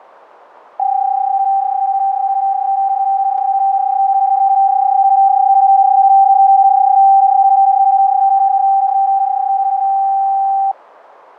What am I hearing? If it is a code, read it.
PSK31 (31.25 baud), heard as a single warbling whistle, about 780 Hz.